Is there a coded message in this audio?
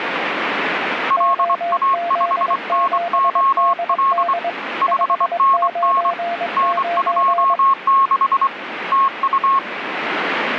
Yes: Morse code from 1.0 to 9.6 s, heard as two keyed tones, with radio static. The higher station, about 24 wpm, 1090 Hz: LA5NOL 5NN N26 TU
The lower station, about 22 wpm, 690 Hz: OZ7DD 599